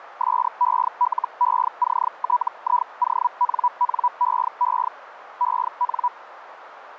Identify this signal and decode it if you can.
Hellschreiber (Feld-Hell, 122.5 baud), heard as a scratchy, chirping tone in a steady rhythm, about 980 Hz, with radio static and a narrow filter. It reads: SELECTIONNEE EN